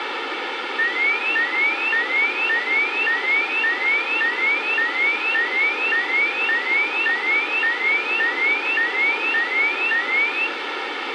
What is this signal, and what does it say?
A tone that sweeps in pitch again and again, with radio hiss. There is no code.